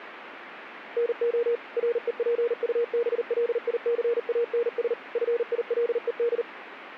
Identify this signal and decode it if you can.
Morse code, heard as a keyed tone, machine-sent, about 39 wpm, 470 Hz, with radio static. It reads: NO REPUBLICANS FILED